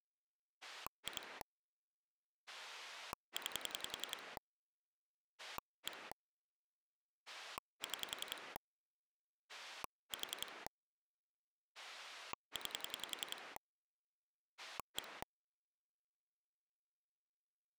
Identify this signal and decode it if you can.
Pulse dialling, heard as a rotary dial, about 10 pulses a second. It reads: 2 9 1 6 4 9 1